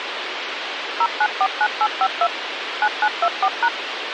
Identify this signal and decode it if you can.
DTMF, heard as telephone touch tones, dialled by machine, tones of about 60 ms, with radio hiss. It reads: 0949852 9924#